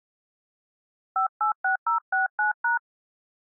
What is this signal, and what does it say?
DTMF, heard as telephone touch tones, dialled by hand, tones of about 120 ms. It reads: 586069#